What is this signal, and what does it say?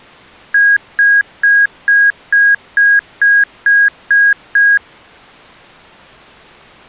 Beep code, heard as beeps, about 1650 Hz. 10 short. In AMI BIOS tables: CMOS shutdown register error.